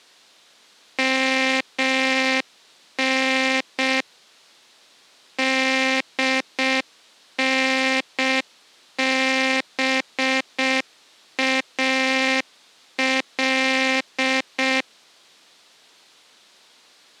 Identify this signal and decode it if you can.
Morse code (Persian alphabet), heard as a buzzer, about 6 wpm. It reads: من دنبال